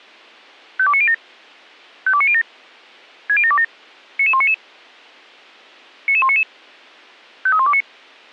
Five-tone selective call (ZVEI), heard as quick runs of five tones, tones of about 70 ms. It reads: 52907 52907 60727 99199 99199 53129